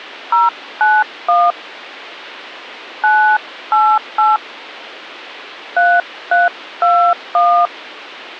DTMF, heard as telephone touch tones, dialled by hand, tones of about 270 ms. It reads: 091 988 3321